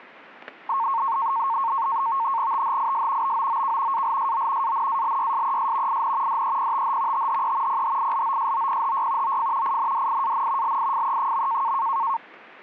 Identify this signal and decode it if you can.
NAVTEX (SITOR-B), 100 baud, 170 Hz shift, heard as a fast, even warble, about 1000 Hz centre, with static crashes. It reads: THIS BOOK ALSO ANALYSES IN DEPTH THE PHILOSOPHY OF INDIAN LIFE.